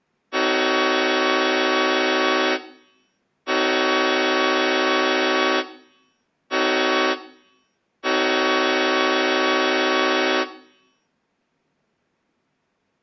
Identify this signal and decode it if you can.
Train horn signal, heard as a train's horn, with room echo. 2 long, 1 short, 1 long. On North American railways: approaching a public crossing.